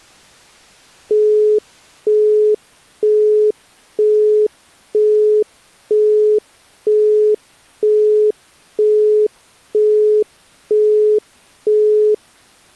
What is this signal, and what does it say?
Telephone call progress tone (single-tone plan, as in Europe, Japan and elsewhere), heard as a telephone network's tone, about 420 Hz, 0.48 s on and 0.48 s off. Busy tone.